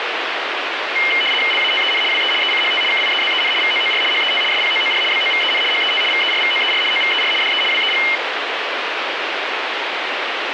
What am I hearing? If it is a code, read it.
RTTY (75 baud, 850 Hz shift), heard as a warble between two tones, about 2550 Hz centre, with radio static. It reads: LATEN WE ECHT KIEZEN VOOR HET SPOOR BOVEN HET VERVOER OVER DE WEG